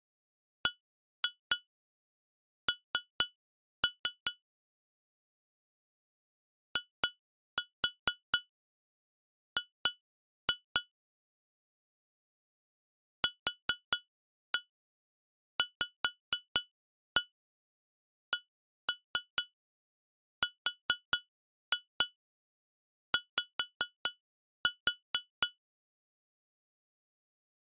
Tap code, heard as taps on glass, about 4 knocks a second. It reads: BN IG QVCRY